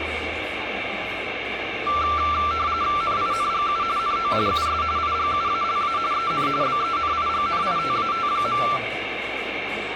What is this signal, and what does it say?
RTTY (45.45 baud, 170 Hz shift), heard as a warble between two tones, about 1260 Hz centre, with radio static and the noise of a cafe. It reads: NINGU NO US IGUALA EN BENIGNITAT.